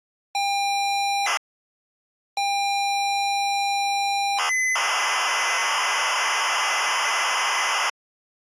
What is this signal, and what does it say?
ZX Spectrum tape loading, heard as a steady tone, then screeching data.